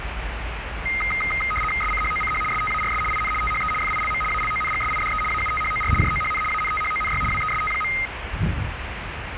RTTY (75 baud, 850 Hz shift), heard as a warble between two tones, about 1700 Hz centre, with radio static and the noise of a residential street. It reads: SCHOCH STARS IN THE FILM ALONGSIDE AUTHOR JOHN ANTHONY WEST.